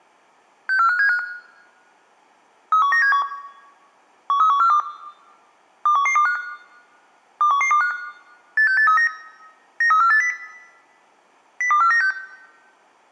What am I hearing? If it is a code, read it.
Five-tone selective call (CCIR), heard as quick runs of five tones, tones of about 100 ms. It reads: 64575 31971 13142 21125 21125 86839 93480 02496